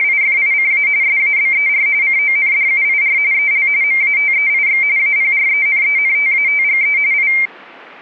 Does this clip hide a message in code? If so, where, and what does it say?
Yes: RTTY (45.45 baud, 170 Hz shift) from 0.0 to 7.5 s, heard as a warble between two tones, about 2200 Hz centre. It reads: … SABER CONDUIR EL MATEIX APRENENTATGE I